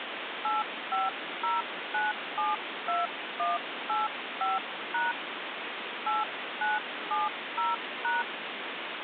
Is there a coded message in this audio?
Yes: DTMF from 0.4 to 8.2 s, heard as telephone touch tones, dialled by hand, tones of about 180 ms, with phone line noise. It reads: 850972185# 8970#